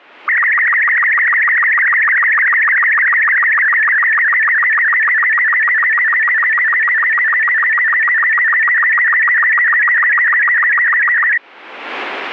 SSTV (slow-scan television), Robot 36, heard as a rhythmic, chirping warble.